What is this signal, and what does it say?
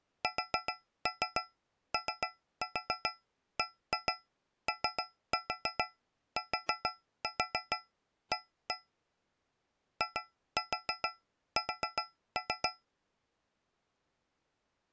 Tap code, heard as taps on a metal pipe, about 7 knocks a second. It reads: SOBOTA IS